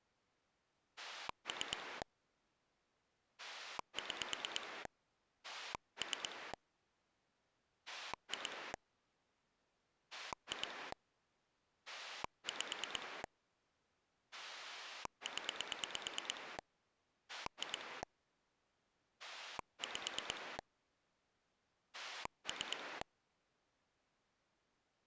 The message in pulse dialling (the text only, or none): 3 6 3 2 2 5 0 2 5 3